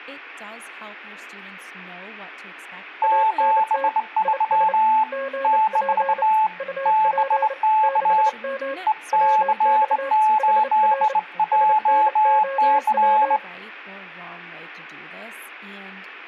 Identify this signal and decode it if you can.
Morse code, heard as two keyed tones, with speech in English. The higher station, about 20 wpm, 870 Hz: 73 - BK EC8JC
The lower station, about 29 wpm, 540 Hz: ANT IS GP UP 6M WX HR SNOW